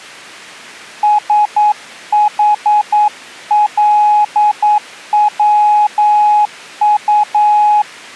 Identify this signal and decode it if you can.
Morse code, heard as a keyed tone, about 9 wpm, 840 Hz. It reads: SHLWU